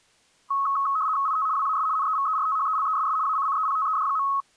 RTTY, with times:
1.3-1.5 IT
1.6-1.9 WAS
2.0-3.2 NEVERTHELESS
3.3-4.3 ACCEPTED.

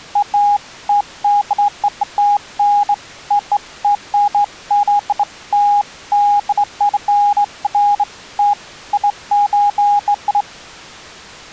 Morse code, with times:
none

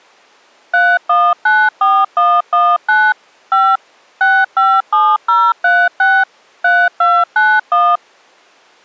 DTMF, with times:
0.7-3.1 3194119
3.5-3.8 5
4.2-6.2 657036
6.6-8.0 3291

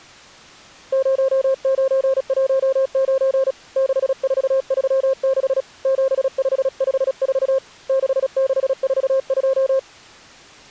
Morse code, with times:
0.9-3.5 0919
3.8-5.6 6436
5.9-7.6 7554
7.9-9.8 6642

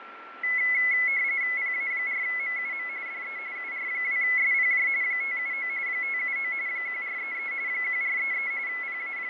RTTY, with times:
1.6-2.9 PA4MUM
3.1-3.4 DE
3.6-4.9 UR2SPJ
5.0-5.7 579
5.9-6.5 579
6.7-7.5 1433
7.7-8.5 1433
8.7-9.3 …

